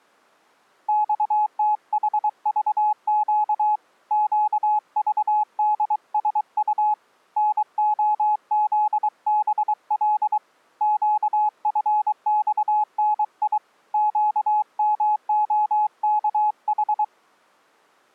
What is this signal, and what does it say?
Morse code, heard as a keyed tone, hand-sent with a paddle, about 23 wpm, 850 Hz. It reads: XTHVQ QVDSU NOZBL QFXNI QMOKH